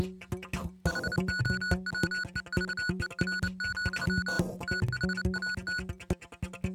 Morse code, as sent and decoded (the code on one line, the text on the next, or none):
.... --- .-- . ...- . .-. --..-- / - .... .- -
HOWEVER, THAT